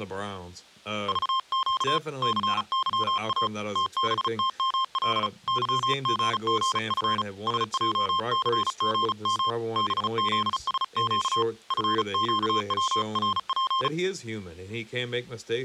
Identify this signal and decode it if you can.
Morse code, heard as a keyed tone, hand-sent with a paddle, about 35 wpm, 1060 Hz, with speech in English. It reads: VQ CYA TBTML YGGF SJCGM BZSQ FQWRP